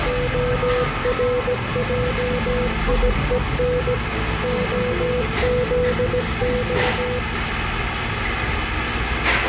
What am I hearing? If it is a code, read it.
Morse code (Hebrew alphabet), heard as a keyed tone, machine-sent, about 17 wpm, 500 Hz, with radio static and the noise of a cafe. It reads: הרעיון הזה